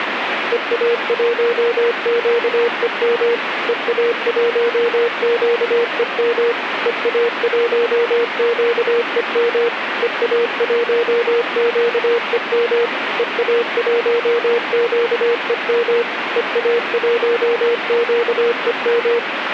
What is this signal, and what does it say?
Morse code, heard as a keyed tone, machine-sent, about 25 wpm, 470 Hz, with radio static. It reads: EA1QEM EA1QEM EA1QEM EA1QEM EA1QEM EA1QEM